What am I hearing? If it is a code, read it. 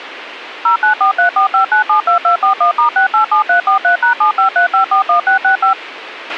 DTMF, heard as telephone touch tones, dialled by machine, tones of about 110 ms, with radio hiss and a squelch burst at the end. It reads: 094345972241*687343#753541665